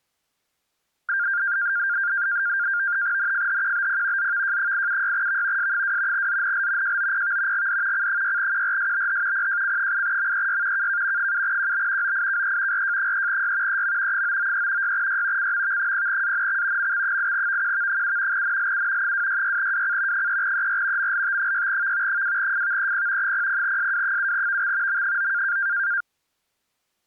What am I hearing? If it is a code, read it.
NAVTEX (SITOR-B), 100 baud, 170 Hz shift, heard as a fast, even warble, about 1500 Hz centre. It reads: NFHQBP ZVJ876V S2 ZNL JOPV GD C6QRSBH PJC8MEY KK 7QB OIKE RJ3Y EM 993 6Y CMV0ANX MX8VQV7 NLU 266WC 3ER MLT6V 2FVEP 00SW7VX M9